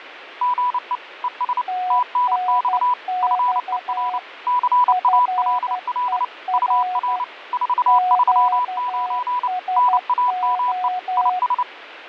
Morse code, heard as two keyed tones, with radio static and fading. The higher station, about 29 wpm, 990 Hz: GE ES TNX FER CALL UR 439 NAME IS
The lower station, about 12 wpm, 730 Hz: TNX FER QSO